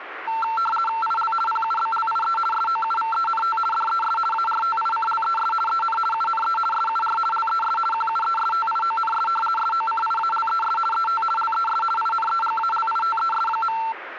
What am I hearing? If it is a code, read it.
RTTY (50 baud, 450 Hz shift), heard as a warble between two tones, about 1120 Hz centre, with radio static. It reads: IL PUBLIE SOUVENT DES ARTICLES EN UNE SUR LES QUESTIONS SOCIALES ET LES INEGALITES.